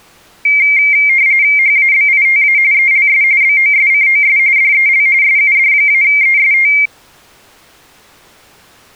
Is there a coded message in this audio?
Yes: RTTY (45.45 baud, 170 Hz shift) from 0.5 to 6.9 s, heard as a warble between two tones, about 2200 Hz centre. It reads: HABITA ELS BOSCOS DEL SUD-EST